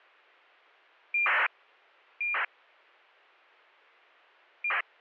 ACARS aircraft data, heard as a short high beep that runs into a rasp, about 2400 baud.